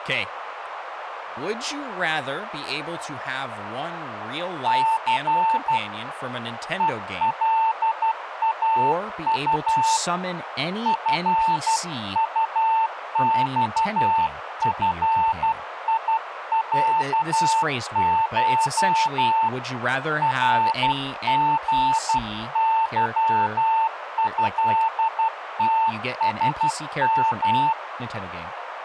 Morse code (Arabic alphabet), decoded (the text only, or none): ث ءلاط فطصفيعش رغظهتسم